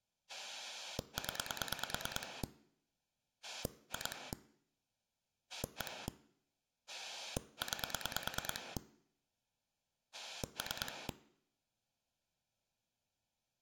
Pulse dialling, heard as a rotary dial, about 9 pulses a second. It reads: 0 2 1 9 3